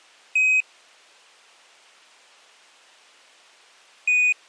Quindar tones, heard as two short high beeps.